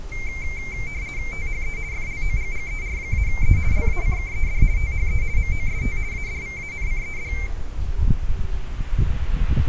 RTTY (50 baud, 170 Hz shift), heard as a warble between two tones, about 2200 Hz centre, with the noise of a park. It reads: THE FLOGGER-E LACKED THE MOST ADVANCED